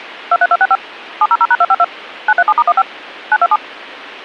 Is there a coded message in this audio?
Yes: DTMF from 0.3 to 3.6 s, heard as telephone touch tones, dialled by machine, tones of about 50 ms. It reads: 23265 700#252 937*15 927